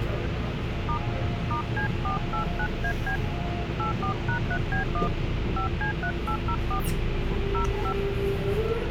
DTMF, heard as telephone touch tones, dialled by hand, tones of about 100 ms, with phone line noise and the noise inside a subway train. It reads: * *C489AB 84#3B1 5C3804 05